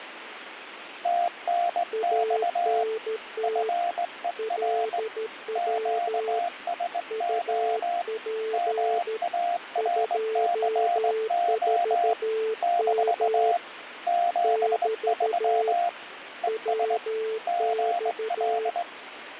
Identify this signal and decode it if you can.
Morse code, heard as two keyed tones, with radio static. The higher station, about 20 wpm, 700 Hz: TNX FER QSO MARCO - 73 ES GL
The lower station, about 13 wpm, 440 Hz: ANT LW UP 24M <BT> WX